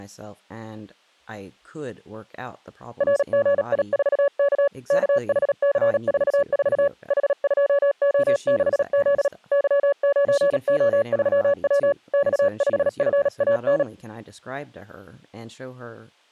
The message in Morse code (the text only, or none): RGI4K KHC44 H2O6Z Y9O3W X5FAN